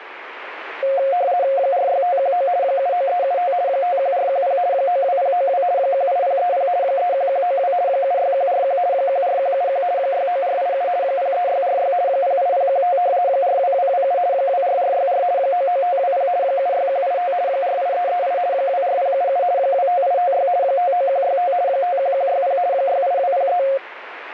RTTY (50 baud, 170 Hz shift), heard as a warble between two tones, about 630 Hz centre, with radio static. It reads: 46519 79375 51410 92092 18030 31192 76141 14171 69487 03646 08015 42227 24464 99520 76185 48338 24077 25856 59165 51160 68203